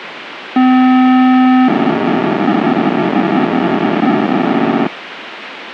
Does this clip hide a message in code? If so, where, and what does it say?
Yes: POCSAG pager data (512 baud) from 0.6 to 4.9 s, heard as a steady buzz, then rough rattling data, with radio hiss and a squelch burst at the end.